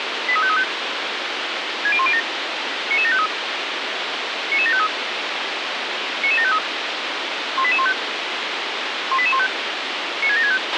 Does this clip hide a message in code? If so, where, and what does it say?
Yes: five-tone selective call (ZVEI) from 0.3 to 10.6 s, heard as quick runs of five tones, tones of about 70 ms, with radio hiss and a squelch burst at the end. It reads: 83535 60107 99753 99753 99753 18815 18815 96765